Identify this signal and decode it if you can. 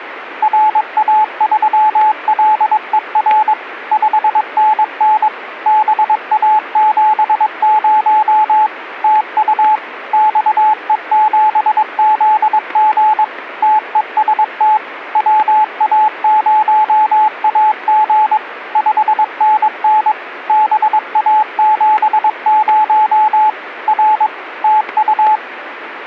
Morse code, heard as a keyed tone, machine-sent, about 22 wpm, 860 Hz, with radio static and static crashes. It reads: RA3LER 5NN BA70 TU XE7ZG TEST WA0AG 5NN BA70 R TU